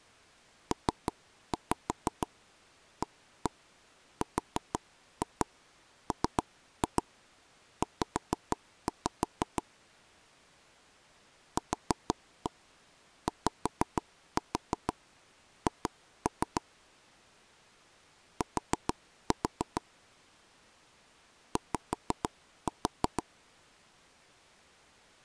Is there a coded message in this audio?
Yes: tap code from 0.7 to 23.2 s, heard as knocks on wood, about 6 knocks a second. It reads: PARMZ QYH T Y